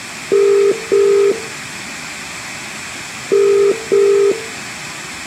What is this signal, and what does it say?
Telephone call progress tone (as in the UK, Ireland, Australia and similar networks), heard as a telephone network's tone, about 400, 450 Hz, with room echo. Ringback tone.